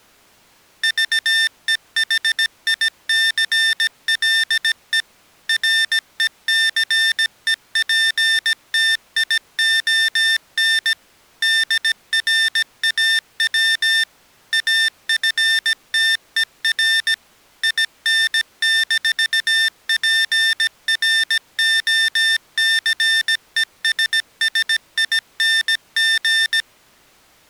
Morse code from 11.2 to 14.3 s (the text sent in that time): DRAW